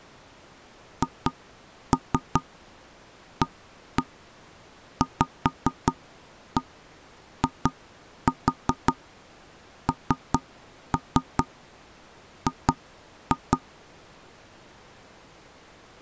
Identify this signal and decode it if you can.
Tap code, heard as knocks on wood, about 5 knocks a second. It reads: HAVING